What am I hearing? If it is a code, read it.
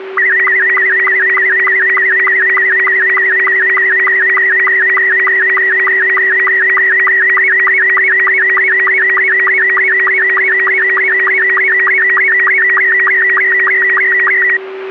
SSTV (slow-scan television), Robot 72, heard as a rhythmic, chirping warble, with radio static and a steady whistle near 380 Hz.